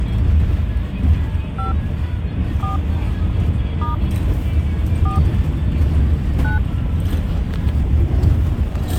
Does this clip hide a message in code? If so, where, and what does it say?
Yes: DTMF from 1.6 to 6.6 s, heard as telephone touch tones, dialled by hand, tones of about 140 ms, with the noise inside a bus. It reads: 5 4 * 4 9